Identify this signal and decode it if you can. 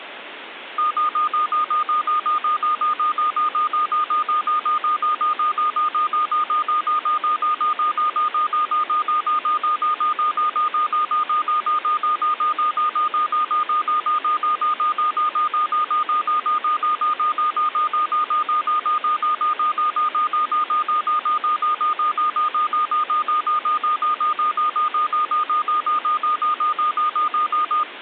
Evenly repeated beeps, with phone line noise. There is no code.